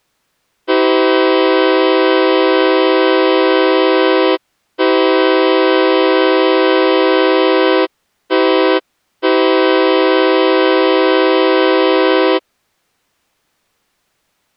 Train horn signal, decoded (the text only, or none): 2 long, 1 short, 1 long